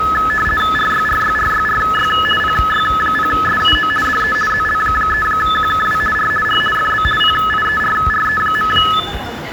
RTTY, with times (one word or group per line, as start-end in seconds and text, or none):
0.8-2.1 RYRYRYRY
2.4-3.9 PY0SUO
4.0-4.3 DE
4.5-6.0 ZL3QKW
6.2-6.3 R
6.5-6.6 R
6.8-7.0 FB
7.2-8.7 PIERRE.